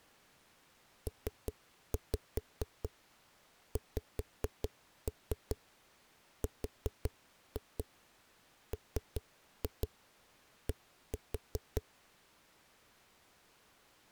Tap code, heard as knocks on a wall, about 5 knocks a second. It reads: PXRMD